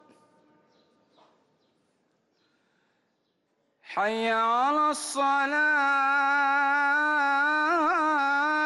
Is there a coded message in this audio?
No.